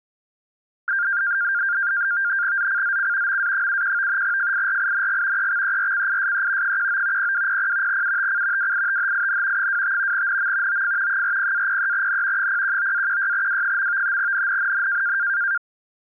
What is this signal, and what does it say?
NAVTEX (SITOR-B), 100 baud, 170 Hz shift, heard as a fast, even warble, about 1500 Hz centre. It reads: ZCZC MA71 FIRING EXERCISE 19 0200 UTC WITHIN 25 NM OF 40-03N 019-16W. NNNN